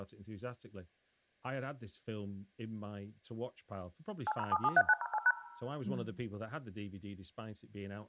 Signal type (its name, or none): DTMF